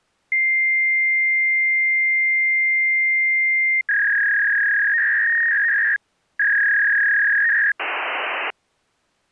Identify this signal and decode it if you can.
Fax machine handshake, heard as a long tone, a warble and hiss.